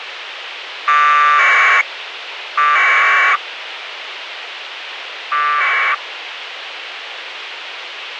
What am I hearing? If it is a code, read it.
Packet radio (AX.25, as in APRS), 1200 baud, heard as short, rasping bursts, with radio hiss and a squelch burst at the end.